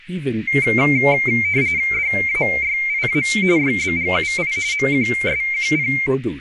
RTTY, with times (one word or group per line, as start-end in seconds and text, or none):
1.9-3.2 DAYIA
3.6-4.5 YBGUI
4.7-5.9 MQSQP